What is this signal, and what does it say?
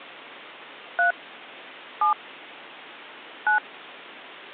DTMF, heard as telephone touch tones, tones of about 120 ms. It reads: 3 7 9